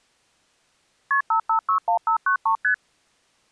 Multi-frequency trunk signalling (R1, as on North American trunks), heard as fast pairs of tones, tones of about 100 ms. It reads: KP 5561593 ST